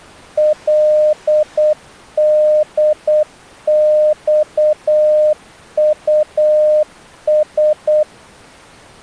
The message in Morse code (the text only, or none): LDXUS